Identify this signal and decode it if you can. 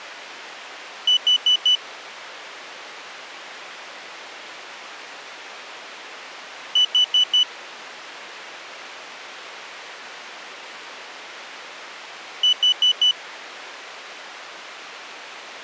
Alarm pattern, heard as an alarm's beeps, played three times, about 3000 Hz. Temporal four. Carbon monoxide.